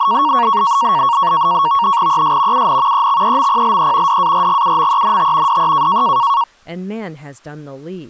NAVTEX (SITOR-B), 100 baud, 170 Hz shift, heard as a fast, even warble, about 1020 Hz centre, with speech in English. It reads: ES UN EXEMPLE DARGUMENT DE